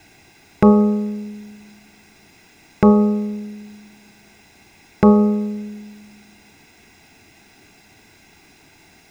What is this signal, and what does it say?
Clock strike, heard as a bell, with room echo. 3. Three o'clock.